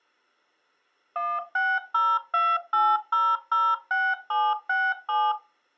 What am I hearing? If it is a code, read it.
DTMF, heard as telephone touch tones, dialled by machine, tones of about 230 ms. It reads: 16028006767